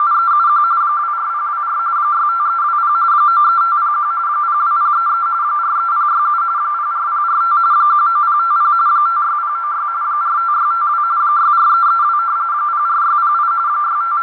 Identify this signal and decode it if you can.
RTTY (45.45 baud, 170 Hz shift), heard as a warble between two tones, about 1270 Hz centre, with radio static, fading and a narrow filter. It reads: … 24024 65320 93501 02033 43067 04045 19050 56096 45652 64332 04608 …